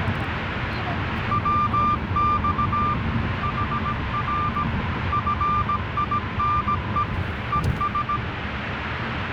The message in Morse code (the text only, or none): WX HR FINE ES